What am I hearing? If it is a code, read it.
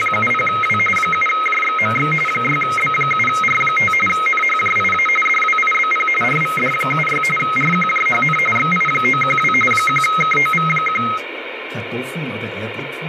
RTTY (45.45 baud, 850 Hz shift), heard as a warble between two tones, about 1700 Hz centre, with radio static. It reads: … 7JXMX 6B7R5 NHJIA DWIBP RVD76 RQJHN XI912 1KOV1